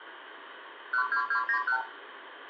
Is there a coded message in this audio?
Yes: multi-frequency trunk signalling (R2, with the far end's replies) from 0.9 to 1.8 s, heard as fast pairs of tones, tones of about 90 ms, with phone line noise and room echo. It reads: 12291